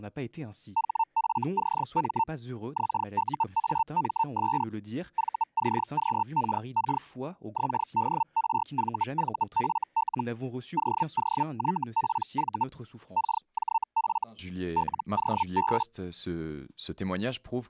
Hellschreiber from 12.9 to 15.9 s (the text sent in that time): KJF LOB